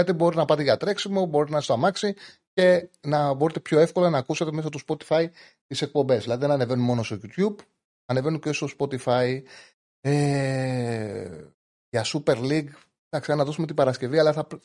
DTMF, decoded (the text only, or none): none